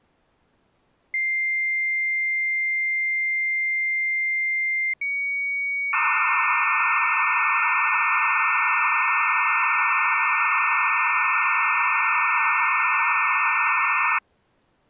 Dial-up modem handshake (low-speed, two carriers), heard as two whistles, then hiss.